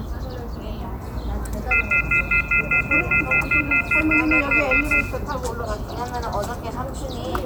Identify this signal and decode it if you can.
Telephone call progress tone (North American plan), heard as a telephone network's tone, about 1400, 2050, 2450, 2600 Hz, 0.1 s on and 0.1 s off, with room echo and the noise of a park. Off-hook warning tone.